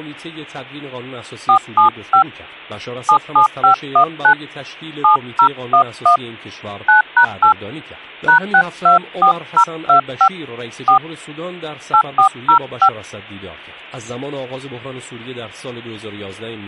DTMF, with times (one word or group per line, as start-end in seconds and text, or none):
1.5-2.2 475
3.1-4.3 77519
5.0-6.2 7011
6.9-7.5 9#8
8.3-10.3 #624025
10.9-11.0 4
11.9-12.9 8405